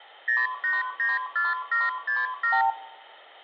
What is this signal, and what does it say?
Multi-frequency trunk signalling (R2, with the far end's replies), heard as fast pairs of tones, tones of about 180 ms, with hum and room echo. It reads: 0894767